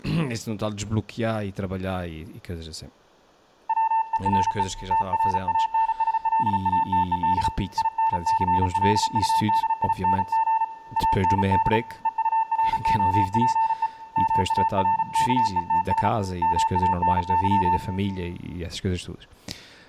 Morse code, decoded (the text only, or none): WERE TRANSLATED INCLUDING AND EUROPE MARKETS MANY